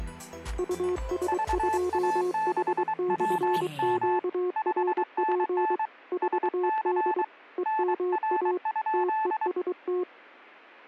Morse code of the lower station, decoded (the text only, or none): US2H/QRP 4D EMA TEST